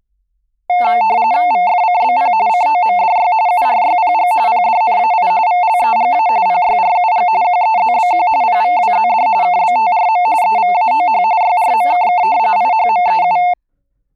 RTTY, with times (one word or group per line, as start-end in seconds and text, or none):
1.5-2.3 VFCBP
2.5-3.3 COMDY
3.5-4.3 URYPG
4.5-5.3 PDNAI
5.5-6.3 VLEGA
6.5-7.3 PYRUG
7.4-8.3 QEZBQ
8.4-9.3 PVWZD
9.4-10.3 KBTRM
10.4-11.2 EVAOH
11.4-12.2 YRMKK
12.6-13.4 IHMEU